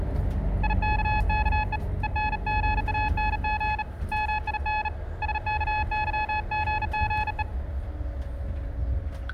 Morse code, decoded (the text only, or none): IKKE ENGANG MIN SKYGGE